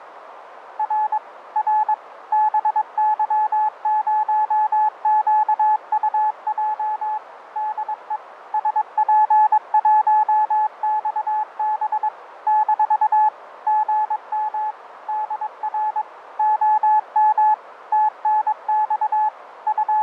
Morse code, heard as a keyed tone, machine-sent, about 22 wpm, 860 Hz, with radio static, fading and a narrow filter. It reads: R R BY0QUJ DE SP1XB - GM DR OM TNX …